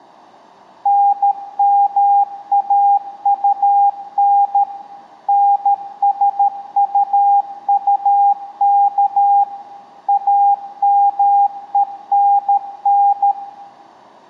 Morse code, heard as a keyed tone, machine-sent, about 13 wpm, 800 Hz, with room echo. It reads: NMAUN NSUUK AMENN